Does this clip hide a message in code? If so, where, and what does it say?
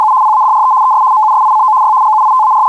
Yes: RTTY (75 baud, 170 Hz shift) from 0.0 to 2.7 s, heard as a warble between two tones, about 950 Hz centre. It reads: … PADRE ES MUSICO Y …